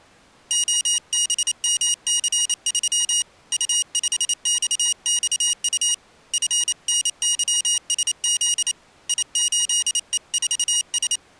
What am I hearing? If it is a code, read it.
Morse code, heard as a high beeper, hand-sent with a paddle, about 28 wpm, 2900 Hz. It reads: OBMC3 U5XXU FNYSZ I8E4S